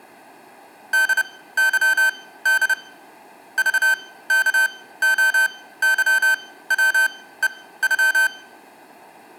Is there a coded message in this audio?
Yes: Morse code (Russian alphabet) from 0.9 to 8.3 s, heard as electronic beeps, machine-sent, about 30 wpm, spaced as for 17 wpm, 1550 Hz. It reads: ДЫД ЖКОЫВЕЮ